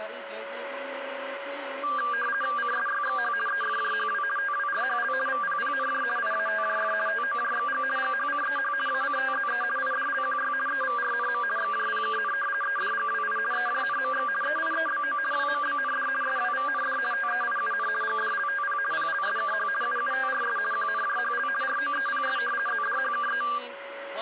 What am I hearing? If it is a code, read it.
RTTY (50 baud, 450 Hz shift), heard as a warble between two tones, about 1390 Hz centre, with radio static and a steady whistle near 560 Hz. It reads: CSYXH EFJHW TWRHL VPPNJ IATJF TOJXG GHCEH ACTZE IDLQY EVRNM XJPKN EDGWI EJNMX EIEBO WMBND SWVND TEIUN GDLTP PLSKH UUTRS QNJHL ROEPS ZDHKE